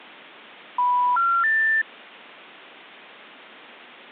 Telephone call progress tone (North American plan), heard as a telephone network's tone, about 980, 1370, 1800 Hz. Special information tone.